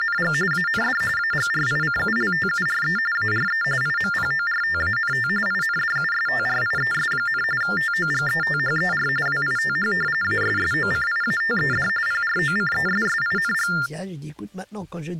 TTY/TDD text telephone tones (45.45 baud Baudot), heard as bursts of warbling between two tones, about 400 Hz shift, 1600 Hz centre. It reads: … AND AGRICULTURE ARE IMPORTANT INDUSTRIES, TOGETHER WITH ASSOCIATED PROCESSING